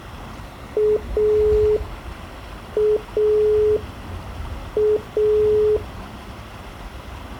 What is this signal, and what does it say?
Telephone call progress tone (pulsed, as in Italy), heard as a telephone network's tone, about 420 Hz, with the noise of a park. Dial tone.